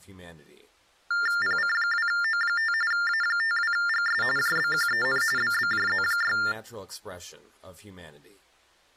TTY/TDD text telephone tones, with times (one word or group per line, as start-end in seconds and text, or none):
1.4-2.7 PC2O5
2.9-4.2 A52GS
4.4-5.2 JBQEN
5.4-6.4 BBJZ6